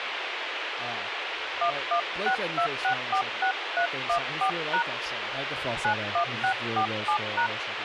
DTMF, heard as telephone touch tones, dialled by hand, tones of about 90 ms, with radio hiss and speech in English. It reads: 1162646314# 91647#